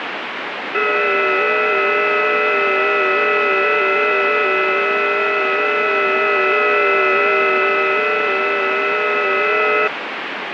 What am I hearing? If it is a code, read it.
FT8 (several signals at once), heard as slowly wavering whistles, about 6.25 baud, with heavy radio static.